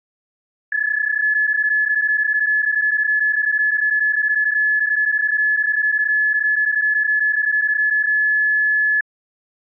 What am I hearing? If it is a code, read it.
PSK31 (31.25 baud), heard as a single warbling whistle, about 1700 Hz.